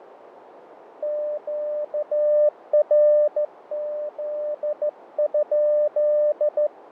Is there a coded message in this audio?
Yes: Morse code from 1.0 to 6.7 s, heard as a keyed tone, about 14 wpm, 600 Hz, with radio static, fading and a narrow filter. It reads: QRZ?